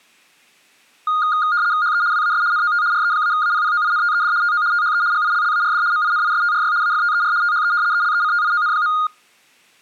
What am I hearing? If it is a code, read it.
RTTY (75 baud, 170 Hz shift), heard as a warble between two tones, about 1330 Hz centre. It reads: HE WAS NOT RE-APPOINTED TO THE GILLARD MINISTRY AFTER THE ELECTION.